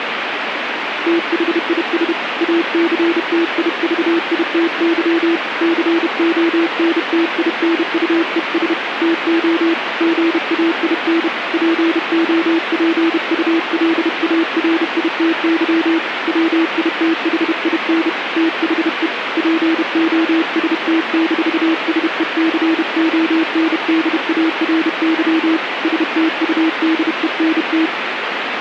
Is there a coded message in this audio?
Yes: Morse code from 1.0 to 27.9 s, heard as a keyed tone, hand-sent with a paddle, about 31 wpm, 330 Hz, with radio static. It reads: THIS ACTIVITY CONTINUES TO GAIN POPULARITY WITHIN THE POST-SECONDARY STUDENT